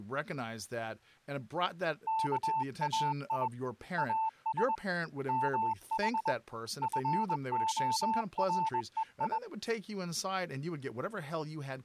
Morse code (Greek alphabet), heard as a keyed tone, hand-sent with a paddle, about 21 wpm, 890 Hz, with speech in English. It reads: ΚΑΙ ΑΣ ΜΗ ΦΟΡΕΙ